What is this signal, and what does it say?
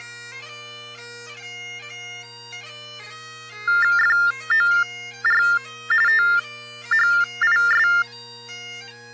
TTY/TDD text telephone tones (45.45 baud Baudot), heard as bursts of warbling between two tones, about 400 Hz shift, 1600 Hz centre. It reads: FOR THIS